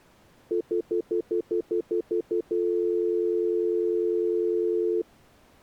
Telephone call progress tone (North American plan), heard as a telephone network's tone, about 350, 440 Hz, 0.1 s on and 0.1 s off. Stutter dial tone.